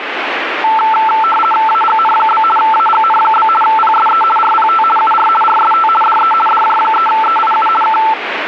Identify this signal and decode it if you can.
RTTY (50 baud, 450 Hz shift), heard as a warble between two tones, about 1110 Hz centre, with radio static. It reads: AGN? AGN? PSE RPT UR RST DE DJ3EIU K